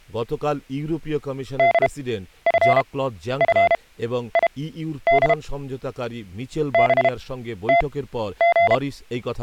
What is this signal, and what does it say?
Morse code, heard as a keyed tone, machine-sent, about 32 wpm, spaced as for 12 wpm, 690 Hz, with speech in Bangla. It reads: DFFID BTG